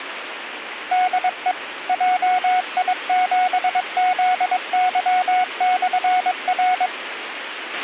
Morse code, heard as a keyed tone, machine-sent, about 22 wpm, 730 Hz, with radio hiss and a squelch burst at the end. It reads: DE JI7ZY/R